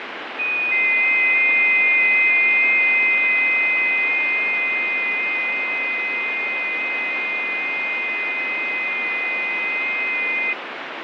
FT8 (several signals at once), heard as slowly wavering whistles, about 6.25 baud, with radio static and fading.